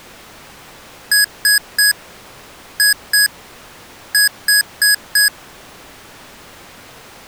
Beep code, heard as beeps from a small speaker, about 1650 Hz. 3-2-4. In Phoenix BIOS tables: keyboard controller failure.